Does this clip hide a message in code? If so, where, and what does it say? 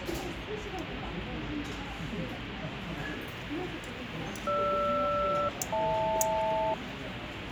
Yes: aircraft SELCAL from 4.5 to 6.7 s, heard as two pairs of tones, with radio static and the noise of a restaurant. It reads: GR-HL